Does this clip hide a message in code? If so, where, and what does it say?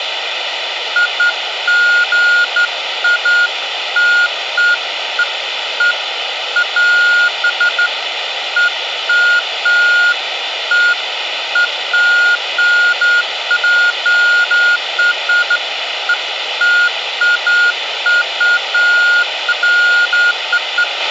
No, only beeps of irregular length, with radio hiss, a squelch burst at the end and room echo.